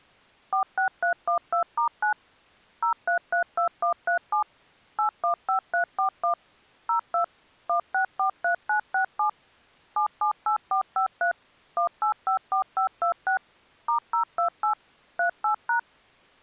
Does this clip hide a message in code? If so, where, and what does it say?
Yes: DTMF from 0.5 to 15.8 s, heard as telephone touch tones, dialled by machine, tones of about 100 ms. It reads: 46312*9 0332137 815341 02 1643967 778453 1854526 *028 38#